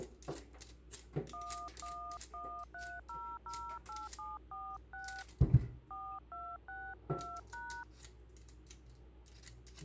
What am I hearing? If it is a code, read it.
DTMF, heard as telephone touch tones, dialled by hand, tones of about 270 ms, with kitchen noise. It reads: 1113008746 4262#